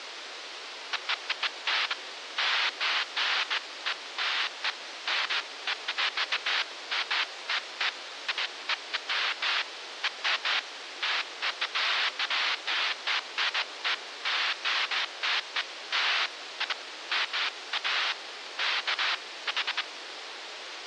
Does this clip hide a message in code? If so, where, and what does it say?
No, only bursts of noise, with radio hiss.